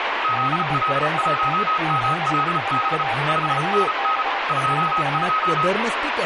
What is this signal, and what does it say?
Morse code, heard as two keyed tones, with radio static and speech in Marathi. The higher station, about 34 wpm, 1270 Hz: ZL1MLB 5NN 22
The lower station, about 27 wpm, 790 Hz: BEST 73 GB <BT>